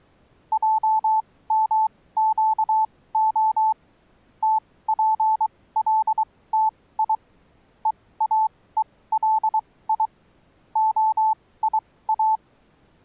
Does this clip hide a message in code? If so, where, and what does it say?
Yes: Morse code (Hebrew alphabet) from 0.5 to 12.4 s, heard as a keyed tone, machine-sent, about 23 wpm, spaced as for 17 wpm, 870 Hz. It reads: עמקה תפלתי ואולי היא